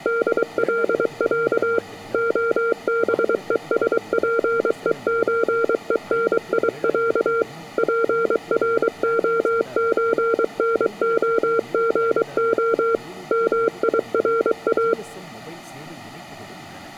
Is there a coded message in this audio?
Yes: Morse code (Russian alphabet) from 0.0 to 15.0 s, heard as a keyed tone, machine-sent, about 23 wpm, 460 Hz, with room echo and speech in Tamil. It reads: ДЛЯ ОБЕСПЕЧЕНИЯ ПРОЧНОГО МИРА